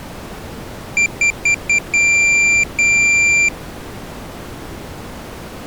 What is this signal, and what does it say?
Beep code, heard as a piezo beeper, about 2350 Hz. 4 short, 2 long.